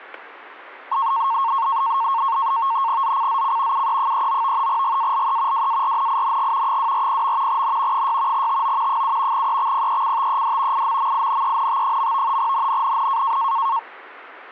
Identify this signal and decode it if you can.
NAVTEX (SITOR-B), 100 baud, 170 Hz shift, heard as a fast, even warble, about 1000 Hz centre, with static crashes. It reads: ZCZC UE39 GALE WARNING 240. N 6 TO 7 EXPECTED IMMINENT. NNNN